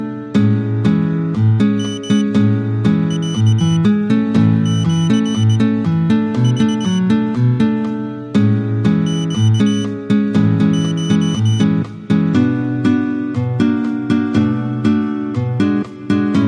Morse code (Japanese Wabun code), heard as a high beeper, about 20 wpm, spaced as for 8 wpm, 3000 Hz. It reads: ヨロシク ネコ